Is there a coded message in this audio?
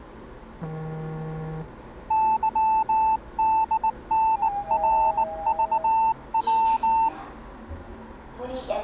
Yes: Morse code (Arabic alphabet) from 2.0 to 7.1 s, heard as a keyed tone, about 19 wpm, 890 Hz, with the noise inside a lift. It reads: ظدنرضو